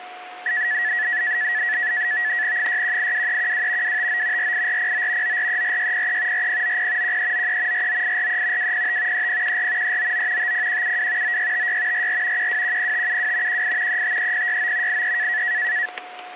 NAVTEX (SITOR-B), 100 baud, 170 Hz shift, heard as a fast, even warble, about 1800 Hz centre, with static crashes and a steady whistle near 730 Hz. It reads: 6182312 259 48409 9434603 4090 1393 49843 205 3014 399 50172 9656 44 1210572 18 353069 83